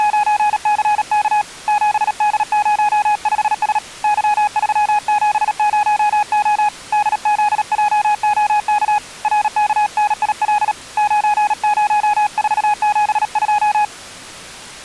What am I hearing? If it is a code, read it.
Morse code, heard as a keyed tone, hand-sent with a paddle, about 37 wpm, 840 Hz. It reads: … 7D05S Y370O DZJOK RKNIL 90472